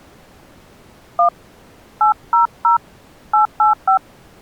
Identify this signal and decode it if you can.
DTMF, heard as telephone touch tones, dialled by hand, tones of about 120 ms. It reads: 1 800 885